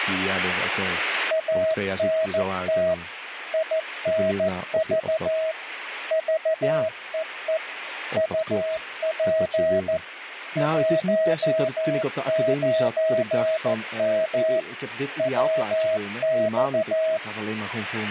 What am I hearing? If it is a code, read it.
Morse code, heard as a keyed tone, machine-sent, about 14 wpm, 640 Hz, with radio static and speech in Dutch. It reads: ANT INV VEE UP 19M WX